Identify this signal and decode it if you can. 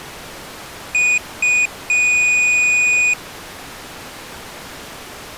Beep code, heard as a piezo beeper, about 2450 Hz. 2 short, 1 long.